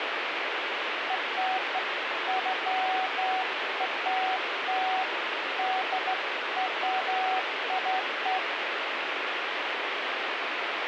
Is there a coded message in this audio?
No, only beeps of irregular length, with radio static.